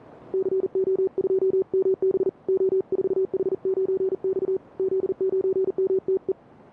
Morse code, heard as a keyed tone, hand-sent with a paddle, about 40 wpm, 380 Hz, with radio static. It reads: CO2MB O4H9X Z9MTE